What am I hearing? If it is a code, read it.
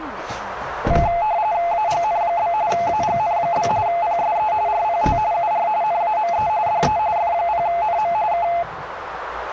RTTY (45.45 baud, 170 Hz shift), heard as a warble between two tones, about 770 Hz centre, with radio static, a narrow filter and the noise inside a car. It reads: AGN? AGN? PSE RPT UR NAME DE F0NM K